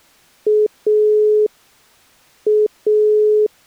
Telephone call progress tone (pulsed, as in Italy), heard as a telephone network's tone, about 420 Hz. Dial tone.